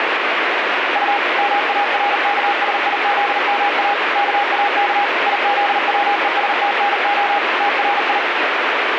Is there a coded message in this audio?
Yes: Morse code (Russian alphabet) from 0.9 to 8.2 s, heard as a keyed tone, machine-sent, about 39 wpm, 810 Hz, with heavy radio static. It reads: У МАРКСИЗМА КАК ИЗВЕСТНО ТРИ